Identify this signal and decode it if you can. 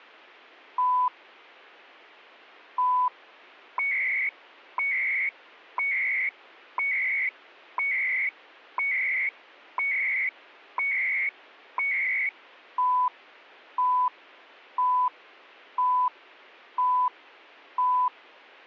Radio time signal (CHU, Canada), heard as beeps and data bursts, one a second.